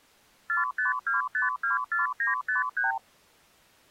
Multi-frequency trunk signalling (R2, with the far end's replies), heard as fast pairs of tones, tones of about 140 ms. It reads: 452524953